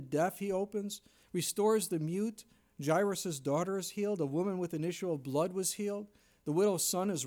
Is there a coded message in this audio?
No.